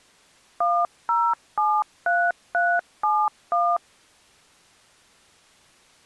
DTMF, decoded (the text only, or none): 1073371